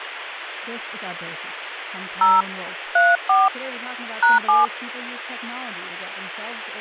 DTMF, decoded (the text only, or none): 0 34 #7